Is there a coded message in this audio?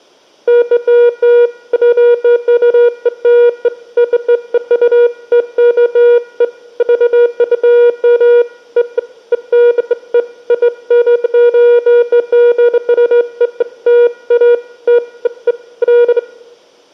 No, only beeps of irregular length, with room echo.